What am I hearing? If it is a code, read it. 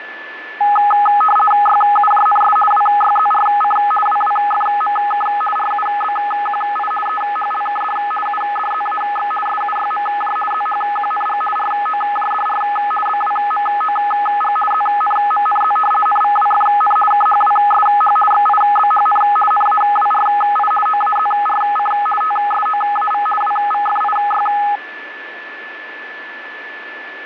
RTTY (50 baud, 450 Hz shift), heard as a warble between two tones, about 1050 Hz centre, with radio static and a steady whistle near 1740 Hz. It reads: YUJNS WYZRC WWFMK RUBQI EHLKD UDZAX SUYMJ ZHQNG ROJDR BWMOG ZNMNZ NVWFN KHWSH XIBHN NAWRI OAZRC TSOAV WVFIY